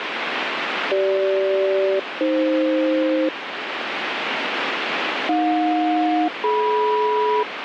Aircraft SELCAL, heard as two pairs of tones, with radio static. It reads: CG-AF AJ-DM